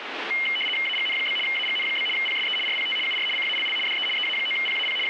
RTTY (75 baud, 850 Hz shift), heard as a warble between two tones, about 2550 Hz centre, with radio static. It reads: AGN? AGN? PSE RPT UR CALL DE EA9PAP …